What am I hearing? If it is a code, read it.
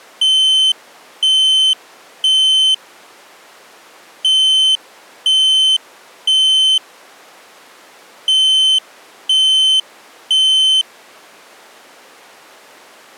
Alarm pattern, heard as an alarm's beeps, played three times, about 3050 Hz. Temporal three. Smoke or fire, evacuate.